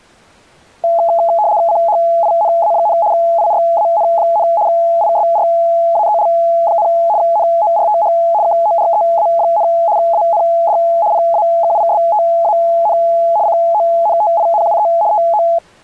RTTY (75 baud, 170 Hz shift), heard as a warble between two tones, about 760 Hz centre. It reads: CHINA, IRAN, ISRAEL, NORTH KOREA, AND PAKISTAN CONTINUE TO